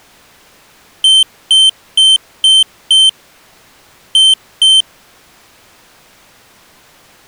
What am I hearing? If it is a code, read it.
Beep code, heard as a piezo beeper, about 3100 Hz. 5-2.